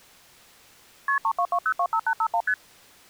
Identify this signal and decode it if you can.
Multi-frequency trunk signalling (R1, as on North American trunks), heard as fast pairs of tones, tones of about 70 ms. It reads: KP 322025851 ST